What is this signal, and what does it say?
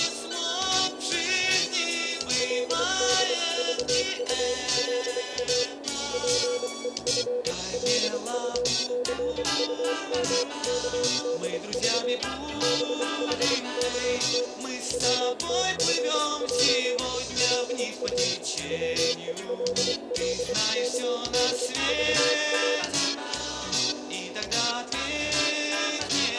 Morse code (Korean alphabet), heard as a keyed tone, hand-sent with a straight key, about 24 wpm, 490 Hz, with radio static and a narrow filter. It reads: 그리고 잔기침을 두어 번하고 밖으로